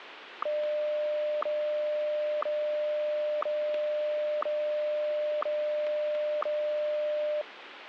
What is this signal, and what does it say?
Radio time signal (WWVH, Hawaii), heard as ticks, one a second, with radio static.